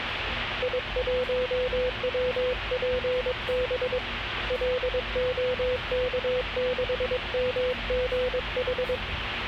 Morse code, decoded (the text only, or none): I1WPB LOK6MGH